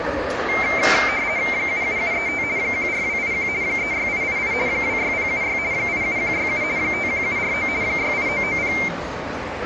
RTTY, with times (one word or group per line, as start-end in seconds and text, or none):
1.5-2.4 77735
2.6-3.5 14281
3.6-4.5 36888
4.7-5.6 26076
5.7-6.6 87167
6.8-7.7 51749
7.8-8.7 68990